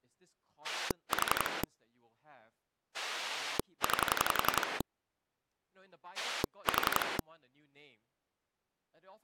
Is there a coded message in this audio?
Yes: pulse dialling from 0.6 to 7.2 s, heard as a rotary dial, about 11 pulses a second, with speech in English. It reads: 4 9 4